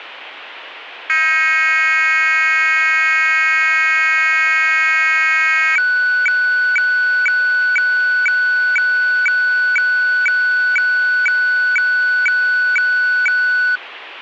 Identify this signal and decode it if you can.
Weather fax (radiofax), 120 lines a minute, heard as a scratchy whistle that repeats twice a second, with radio static.